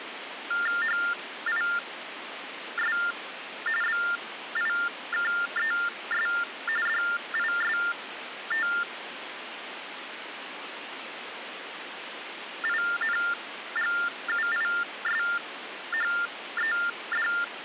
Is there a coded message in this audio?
Yes: TTY/TDD text telephone tones (45.45 baud Baudot) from 0.5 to 17.4 s, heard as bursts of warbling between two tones, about 400 Hz shift, 1600 Hz centre, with phone line noise. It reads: HIS BIKES DISTINGUISHED